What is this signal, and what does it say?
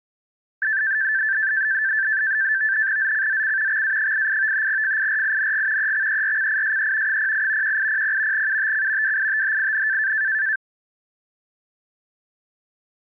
NAVTEX (SITOR-B), 100 baud, 170 Hz shift, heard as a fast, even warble, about 1650 Hz centre. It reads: ZCZC XA88 FIRING EXERCISE 08 1800 UTC WITHIN